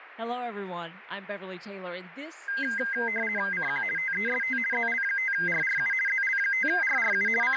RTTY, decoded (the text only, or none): CQ TEST ZL5RRU ZL5RRU …